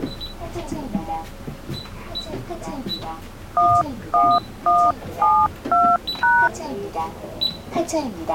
DTMF, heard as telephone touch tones, dialled by hand, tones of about 240 ms, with the noise inside a bus. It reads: 11172#